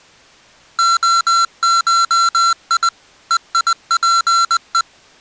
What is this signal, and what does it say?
Morse code (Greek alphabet), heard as electronic beeps, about 20 wpm, 1360 Hz. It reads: ΟΧΙ ΕΙΠΕ